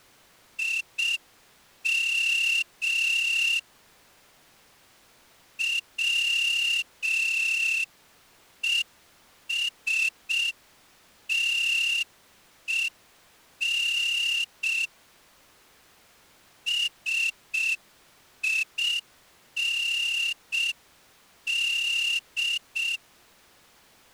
Morse code, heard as a whistle, hand-sent with a straight key, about 6 wpm. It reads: IM WESTEN SIND